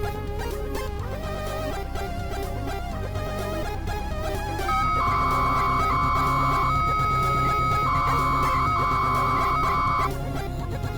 300-baud modem data (Bell 103 tones), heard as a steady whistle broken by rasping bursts, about 300 baud, 200 Hz shift.